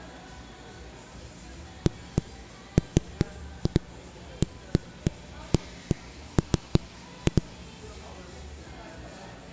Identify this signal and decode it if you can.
Irregular knocks on a wall, with the noise of a cafe. There is no code.